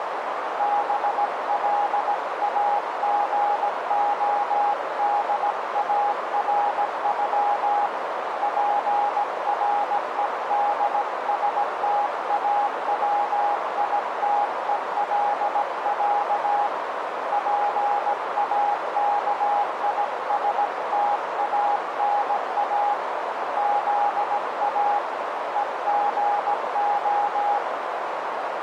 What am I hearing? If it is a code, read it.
Morse code (Russian alphabet), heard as a keyed tone, hand-sent with a paddle, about 17 wpm, 820 Hz, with heavy radio static and a narrow filter. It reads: БЛАГОДАРЮ ПРЕДСТАВИТЕЛЯ ПАКИСТАНА ЗА ЕГО